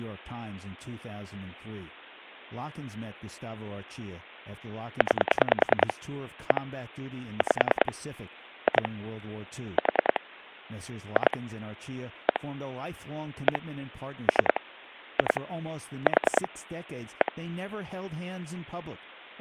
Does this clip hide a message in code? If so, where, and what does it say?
Yes: pulse dialling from 5.0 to 17.3 s, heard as clicks on a phone line, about 10 pulses a second, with speech in English. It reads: 9 1 5 2 4 2 1 1 3 2 4 1